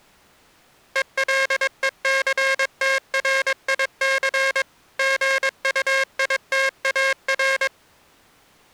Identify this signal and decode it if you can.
Morse code, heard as a buzzer, machine-sent, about 22 wpm. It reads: ELECTRIC GUITAR